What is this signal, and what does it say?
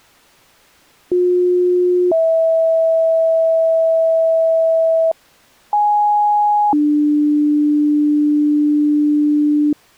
Two-tone page, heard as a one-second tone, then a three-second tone, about 360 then 650 Hz, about 830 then 300 Hz.